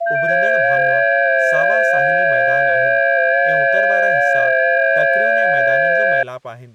FT8 (several signals at once), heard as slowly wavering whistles, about 6.25 baud, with speech in Sindhi.